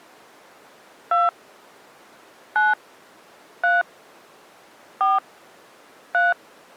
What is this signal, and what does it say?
DTMF, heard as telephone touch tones, dialled by hand, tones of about 180 ms. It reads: 2 9 3 4 3